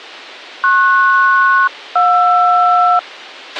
Aircraft SELCAL, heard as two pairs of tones, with a squelch burst at the end. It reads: PS-JR